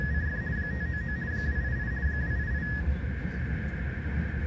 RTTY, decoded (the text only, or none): … 599 288 288